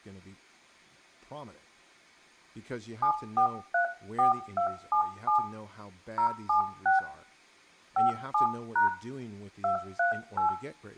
DTMF, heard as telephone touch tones, dialled by hand, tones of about 110 ms, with room echo and speech in English. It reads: 7434277 076 57# 238